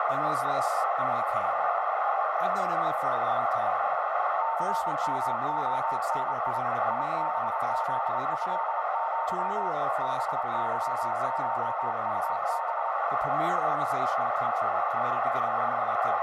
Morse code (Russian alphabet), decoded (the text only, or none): ЦМОНИ ИБЗЭЪ БЫШУБ